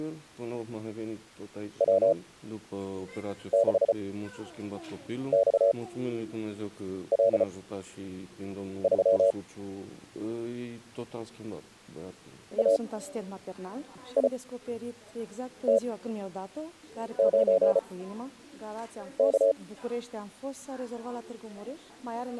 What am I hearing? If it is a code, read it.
Morse code, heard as a keyed tone, machine-sent, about 34 wpm, spaced as for 6 wpm, 560 Hz. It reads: W6XL3 AIT9K